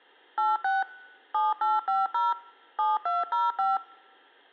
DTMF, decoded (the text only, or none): 86 7850 7205